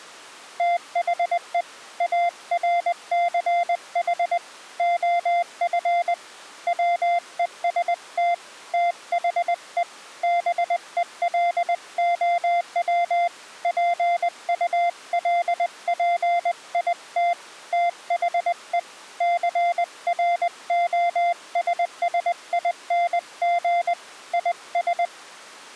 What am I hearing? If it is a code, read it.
Morse code, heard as a keyed tone, hand-sent with a paddle, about 20 wpm, 700 Hz. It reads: THE ARCH OF WEST THE BELOW PULPIT THE CROSSING IS